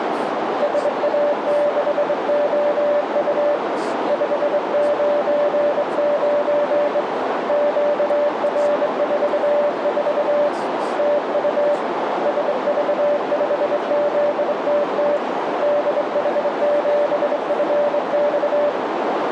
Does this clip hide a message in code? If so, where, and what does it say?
Yes: Morse code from 0.6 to 18.8 s, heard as a keyed tone, hand-sent with a straight key, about 23 wpm, 590 Hz, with heavy radio static, a narrow filter and speech in English. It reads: SA6OU 599 QR44 TU SV5ZTT DH7FX